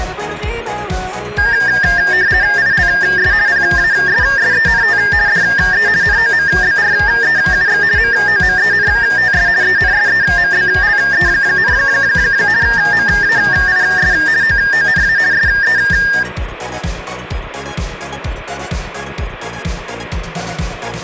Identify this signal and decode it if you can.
RTTY (50 baud, 170 Hz shift), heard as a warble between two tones, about 1700 Hz centre. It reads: ILS PASSENT DE NOMBREUX MOMENTS ENSEMBLE, MAIS OONA SE